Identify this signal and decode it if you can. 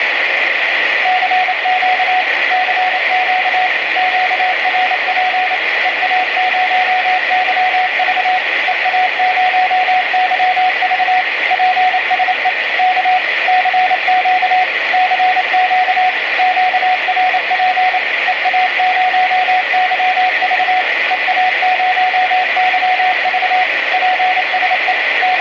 Morse code, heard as a keyed tone, machine-sent, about 28 wpm, 740 Hz, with radio static. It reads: CQ CQ QRP EA0YV EA0YV PSE K CQ CQ QRP EA0YV EA0YV PSE …